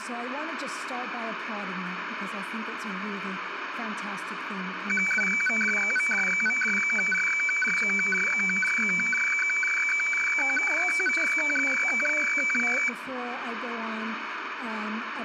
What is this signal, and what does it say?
Weather fax (radiofax), 120 lines a minute, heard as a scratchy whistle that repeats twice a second, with radio static.